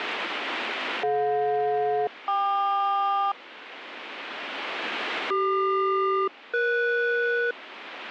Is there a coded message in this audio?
Yes: aircraft SELCAL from 1.0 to 7.5 s, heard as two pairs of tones, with radio static. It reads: DJ-KQ CQ-ES